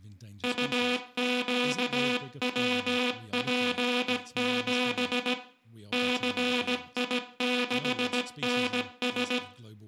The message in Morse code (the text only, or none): UQWP7 CI6NS